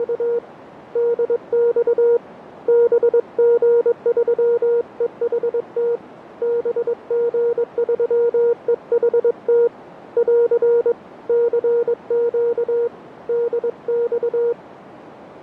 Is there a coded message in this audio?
Yes: Morse code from 0.0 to 14.6 s, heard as a keyed tone, hand-sent with a paddle, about 22 wpm, 470 Hz, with radio static and a narrow filter. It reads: … DX BG3EHT BG3EHT <AR> CQ DX